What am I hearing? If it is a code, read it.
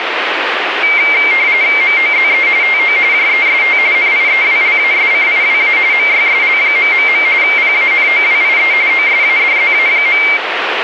RTTY (45.45 baud, 170 Hz shift), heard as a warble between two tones, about 2200 Hz centre, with radio static. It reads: MOZE TO JEST NIEWLASCIWA MYSL... PANOWIE OSADZA.